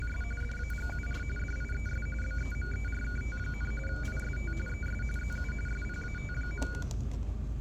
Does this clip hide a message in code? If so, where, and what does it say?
Yes: RTTY (45.45 baud, 850 Hz shift) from 0.0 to 6.8 s, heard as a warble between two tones, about 1850 Hz centre, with static crashes and the noise inside a bus. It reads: … DAGUR DIES BEMERKT, IST ES ZU SPAT.